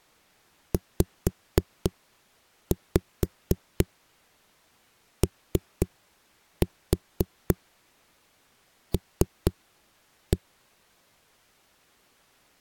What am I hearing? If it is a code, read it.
Tap code, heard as knocks on a wall, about 4 knocks a second. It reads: ZOL